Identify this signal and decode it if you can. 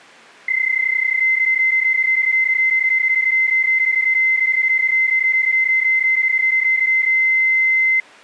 PSK31 (31.25 baud), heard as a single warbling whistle, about 2050 Hz.